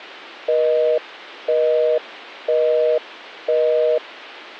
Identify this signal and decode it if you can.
Telephone call progress tone (North American plan), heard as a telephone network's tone, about 480, 620 Hz, 0.5 s on and 0.5 s off. Busy tone.